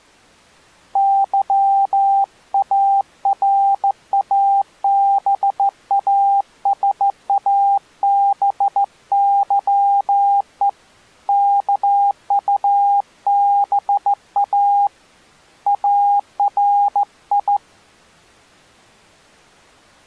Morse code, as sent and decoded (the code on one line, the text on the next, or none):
-.-- .- .-. .- -... .- ... .- -... -.-- . / -.- ..- -... .- / .- .-. ..
YARABASABYE KUBA ARI